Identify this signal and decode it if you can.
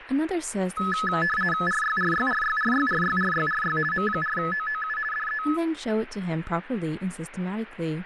RTTY (50 baud, 450 Hz shift), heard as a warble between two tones, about 1500 Hz centre, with radio static and speech in English. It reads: RYRYRYRYRYRYRY M4OOU DE